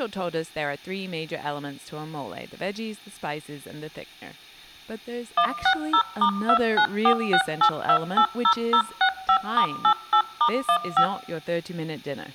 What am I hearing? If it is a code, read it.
DTMF, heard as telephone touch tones, dialled by machine, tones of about 80 ms, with speech in English. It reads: 160*29468280065*88*15